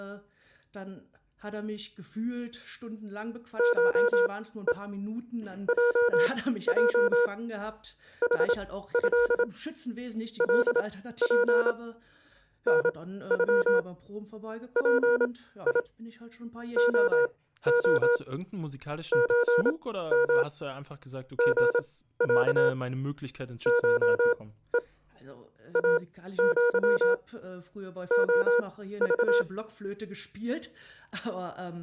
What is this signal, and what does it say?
Morse code (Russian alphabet), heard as a keyed tone, machine-sent, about 27 wpm, spaced as for 15 wpm, 480 Hz. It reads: ШЕ ЙЙ ХЭ ЛП НЮ ПИ ОО ЧМ ГЯ ШЕ АЪ ОЖ